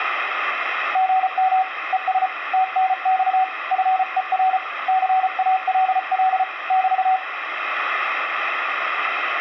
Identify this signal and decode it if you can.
Morse code, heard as a keyed tone, hand-sent with a paddle, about 34 wpm, 750 Hz, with radio static and room echo. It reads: GM ES TNX FER CALL <BT>